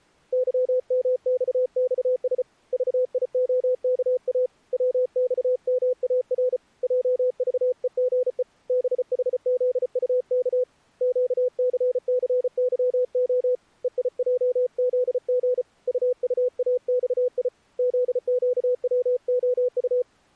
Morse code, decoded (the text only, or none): YMXXS VIOKA WXMAR JVEGE BHZUK QCCYO EIJZG UUAXI ZQWOU